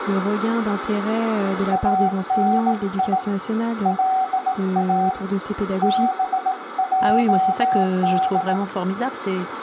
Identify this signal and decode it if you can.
Morse code (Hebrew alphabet), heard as a keyed tone, hand-sent with a bug key, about 18 wpm, 760 Hz, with radio static, room echo and speech in French. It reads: אני לא בעד